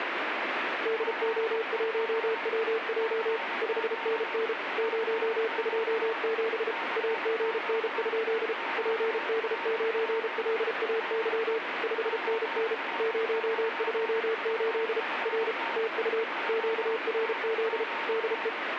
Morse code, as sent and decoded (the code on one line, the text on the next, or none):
-.. --- .---- .-- .--- / ..... -. -. / ----- ..--- --... / .- --. -. ..--.. / .--. -.. ----. .-.. .- -.-- / ..... -. -. / ----- ..--- ---.. / .-. / - ..- / --.- .-. --.. / -.. .
DO1WJ 5NN 027 AGN? PD9LAY 5NN 028 R TU QRZ DE